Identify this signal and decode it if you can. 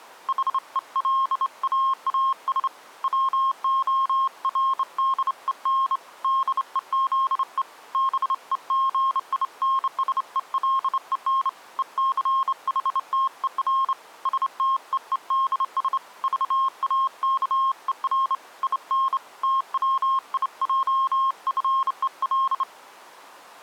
Morse code, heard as a keyed tone, hand-sent with a straight key, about 28 wpm, 1070 Hz. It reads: HELAAS WORDEN DEZE BEGINSELEN ECHTER STEEDS VAKER IN TWIJFEL